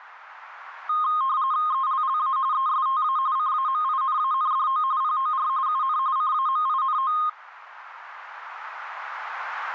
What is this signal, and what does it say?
RTTY (45.45 baud, 170 Hz shift), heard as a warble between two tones, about 1150 Hz centre, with radio static. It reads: ELLA ESTA CAMINANDO POR UN CAMINO